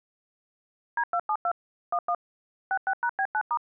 DTMF, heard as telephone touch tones, dialled by machine, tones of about 60 ms. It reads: D272 11 66#B9*